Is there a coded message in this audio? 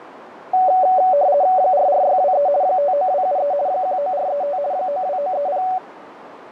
Yes: RTTY (50 baud, 170 Hz shift) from 0.5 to 5.8 s, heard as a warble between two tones, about 660 Hz centre, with radio static and a narrow filter. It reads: 44623 59273 19435 92930